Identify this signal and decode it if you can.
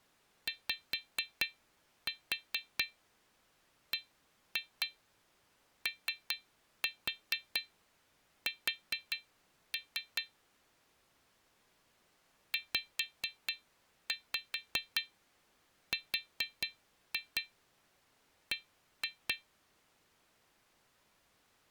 Tap code, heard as taps on glass, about 4 knocks a second. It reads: YBOS ZRB